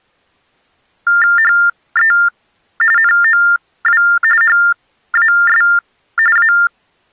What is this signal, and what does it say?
TTY/TDD text telephone tones (45.45 baud Baudot), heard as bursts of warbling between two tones, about 400 Hz shift, 1600 Hz centre. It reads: HE NOW HAS A